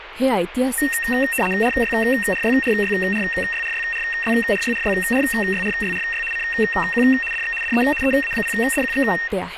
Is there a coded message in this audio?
Yes: RTTY (75 baud, 850 Hz shift) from 0.8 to 9.3 s, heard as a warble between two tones, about 2300 Hz centre, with radio static and speech in Marathi. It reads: RYRYRYRYRYRYRYRYRYRYRY CQ DX DE EA0DQX